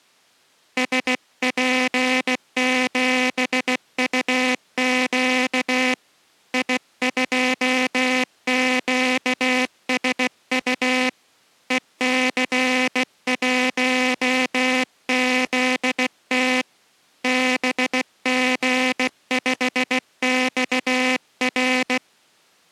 Morse code, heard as a buzzer, hand-sent with a bug key, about 16 wpm. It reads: SP7UQ I2QSU EC1ZT BG5XR